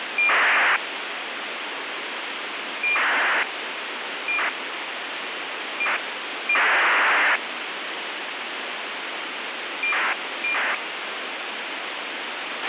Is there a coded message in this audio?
Yes: ACARS aircraft data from 0.2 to 10.8 s, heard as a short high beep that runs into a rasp, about 2400 baud, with radio hiss and a squelch burst at the end.